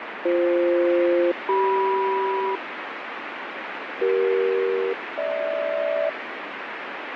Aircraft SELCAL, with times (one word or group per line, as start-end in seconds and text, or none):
0.3-2.6 BF-CM
4.0-6.1 CE-GH